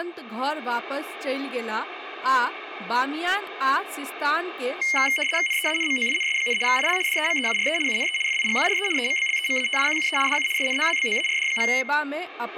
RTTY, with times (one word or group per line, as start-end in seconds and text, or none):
5.5-6.6 NEANMOINS,
6.7-7.0 IL
7.1-7.8 DEMEURE
7.9-8.2 UNE
8.3-8.9 FIGURE
9.0-10.2 EMBLEMATIQUE
10.3-10.5 DU
10.6-11.7 SNOWBOARD.